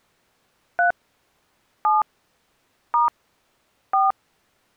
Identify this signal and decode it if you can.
DTMF, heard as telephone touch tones, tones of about 170 ms. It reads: 3 7 * 4